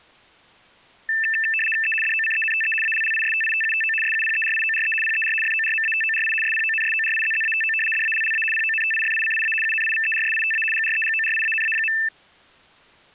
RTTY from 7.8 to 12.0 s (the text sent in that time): DALLA PONTIFICIA UNIVERSITA GREGORIANA.